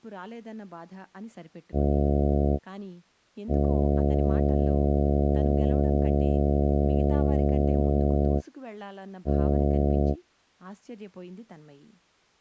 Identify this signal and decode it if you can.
Ship horn signal, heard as a ship's horn, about 70 Hz, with speech in Tamil. 1 short, 1 long, 1 short. At sea: a vessel at anchor warns of its position.